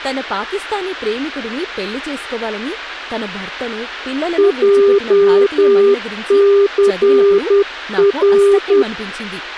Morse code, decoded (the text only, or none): JCR